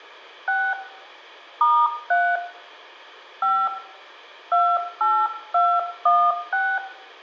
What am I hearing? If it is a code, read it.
DTMF, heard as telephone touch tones, dialled by hand, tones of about 260 ms, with room echo. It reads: 6 *3 5 28216